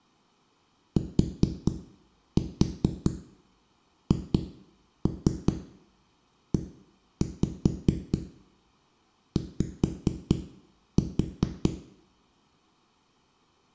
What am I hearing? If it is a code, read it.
Tap code, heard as knocks on a wall, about 4 knocks a second, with room echo. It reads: THEY